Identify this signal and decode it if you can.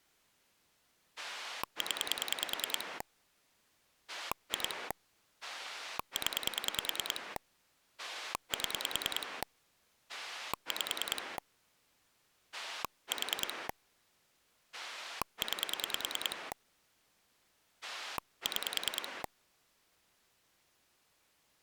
Pulse dialling, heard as a rotary dial, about 10 pulses a second. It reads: 0 2 0 7 5 4 9 6